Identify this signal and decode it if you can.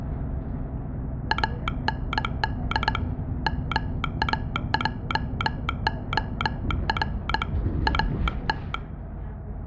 Morse code, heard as a telegraph sounder, hand-sent with a straight key, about 20 wpm, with the noise inside a bus. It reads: AND MAJOR AT